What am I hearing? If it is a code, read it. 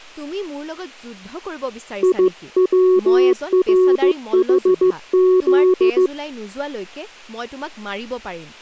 Morse code, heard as a keyed tone, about 15 wpm, 370 Hz, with speech in Assamese. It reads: IWRHZ